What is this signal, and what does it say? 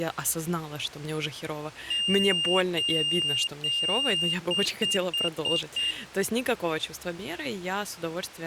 Beep code, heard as a piezo beeper, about 2800 Hz, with speech in Ukrainian. 3 long, 5 short.